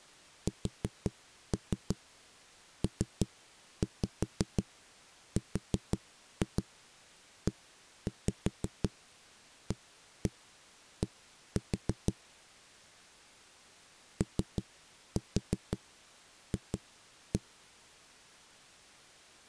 Tap code, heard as knocks on a wall, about 5 knocks a second. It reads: SPREAD OF